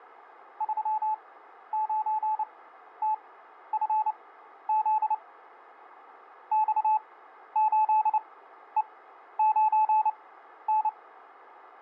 Morse code, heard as a keyed tone, machine-sent, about 29 wpm, spaced as for 12 wpm, 860 Hz, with radio static. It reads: 39TFZ X8E9N